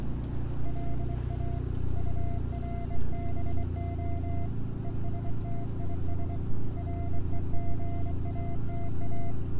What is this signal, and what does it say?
Morse code, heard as a keyed tone, hand-sent with a straight key, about 24 wpm, 690 Hz, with radio static, a narrow filter and street noise. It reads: LA URBO ESTIS REGATA